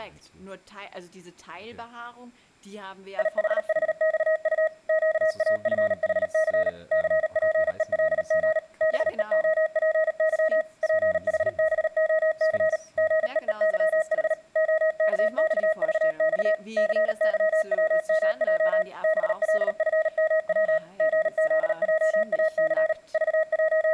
Morse code, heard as a keyed tone, machine-sent, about 38 wpm, 630 Hz, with speech in German. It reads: IHHXU QAFHC CPELG BEOPY PHBOC GEEYH OKXVX CYWMJ BLFMW GZJAC …